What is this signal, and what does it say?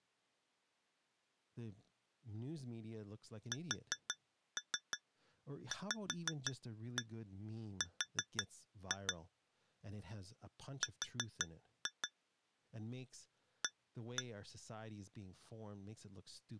Tap code, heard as taps on glass, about 6 knocks a second, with speech in English. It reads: SVR R A